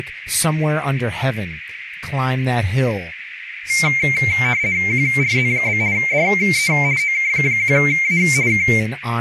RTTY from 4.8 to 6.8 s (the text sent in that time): QRZ? DE